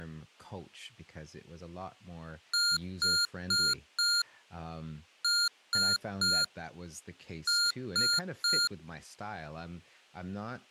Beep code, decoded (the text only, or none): 4-3-3